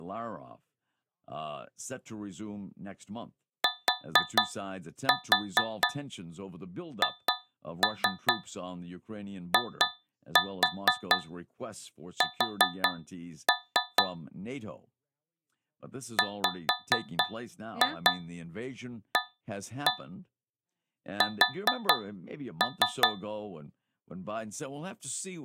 Tap code, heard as taps on a metal pipe, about 4 knocks a second, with speech in English. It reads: THIS WAS